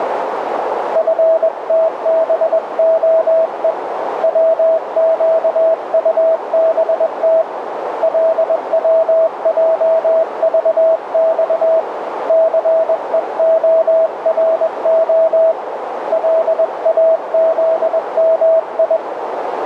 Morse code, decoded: FTBOE WQUBT LWJVX CEORO LAZMI

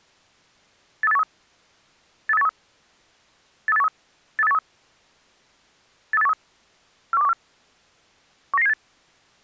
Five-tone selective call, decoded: 83813 83813 83813 83813 83813 41214 19978

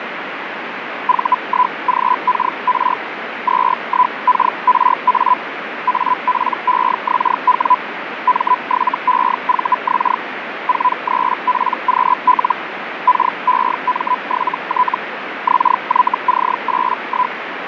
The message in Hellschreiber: V1GKR 21KRA APEXW M7EVX 43PQL KEM7T XYC81

